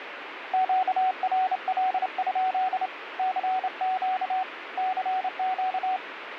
Morse code, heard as a keyed tone, hand-sent with a straight key, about 28 wpm, 750 Hz, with radio static. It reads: QRL? CQ CQ